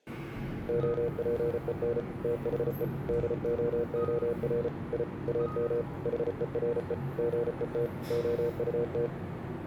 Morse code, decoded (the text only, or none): OPEN THE DOOR I AM HERE GET OUT